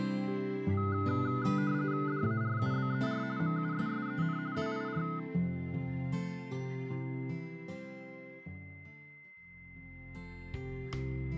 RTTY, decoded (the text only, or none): DARUBER MUSSEN WIR